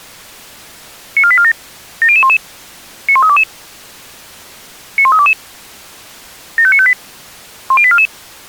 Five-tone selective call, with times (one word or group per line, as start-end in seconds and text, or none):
1.2-1.5 94847
2.0-2.4 70011
3.1-3.4 91322
5.0-5.3 91322
6.6-6.9 75958
7.7-8.1 10844